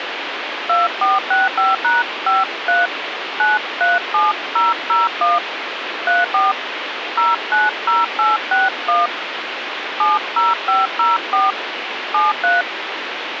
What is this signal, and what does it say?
DTMF, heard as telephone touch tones, dialled by hand, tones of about 180 ms, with radio hiss. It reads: 2465#53 937001 34 090861 70504 73